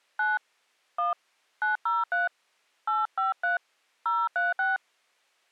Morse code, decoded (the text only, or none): none